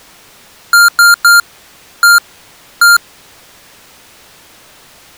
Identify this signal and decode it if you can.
Beep code, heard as beeps from a small speaker, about 1400 Hz. 3-1-1. In Phoenix BIOS tables: DMA register failure.